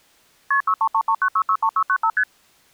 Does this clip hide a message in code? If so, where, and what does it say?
Yes: multi-frequency trunk signalling (R1, as on North American trunks) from 0.5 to 2.2 s, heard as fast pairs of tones, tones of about 70 ms. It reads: KP 63339663695 ST